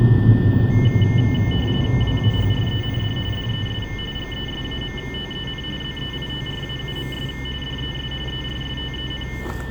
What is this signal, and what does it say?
RTTY (45.45 baud, 850 Hz shift), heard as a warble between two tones, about 2550 Hz centre, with radio static, a steady whistle near 1800 Hz, room echo and the noise inside a car. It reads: WAHREND DES GESAMTEN ZEITRAUMS DES ERSTEN